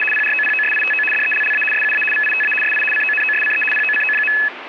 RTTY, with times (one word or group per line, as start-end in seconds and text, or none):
0.0-0.0 …
0.1-1.0 PROPOSITO
1.1-1.6 DELLA
1.7-2.0 SUA
2.1-2.5 VITA
2.6-2.8 SI
2.9-3.6 CONOSCE
3.7-4.3 POCO.